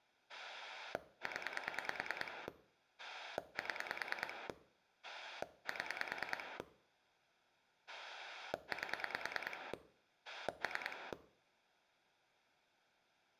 Pulse dialling, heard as a rotary dial, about 9 pulses a second. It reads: 0 7 7 8 3